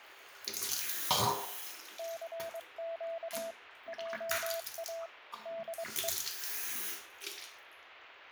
Morse code, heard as a keyed tone, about 23 wpm, 660 Hz, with radio static and the noise of a restroom. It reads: CQ JA DE